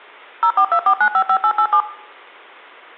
DTMF, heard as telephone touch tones, dialled by machine, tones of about 80 ms, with room echo. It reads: 0424955887